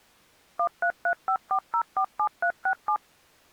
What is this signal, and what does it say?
DTMF, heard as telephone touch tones, dialled by machine, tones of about 80 ms. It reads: 13354047367